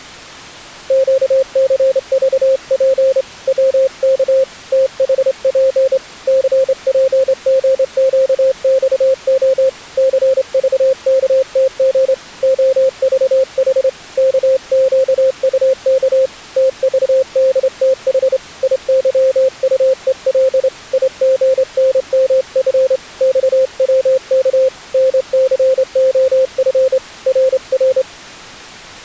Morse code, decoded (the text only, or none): QCVP WK THP CPGQXO CVKTG OVH KQUK TVDTH IYUEL IGNMF XWK NCOF RR